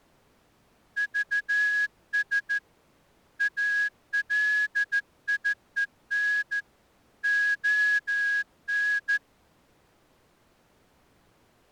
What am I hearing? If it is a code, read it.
Morse code, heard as a whistle, hand-sent with a straight key, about 14 wpm. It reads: VS ALIEN ON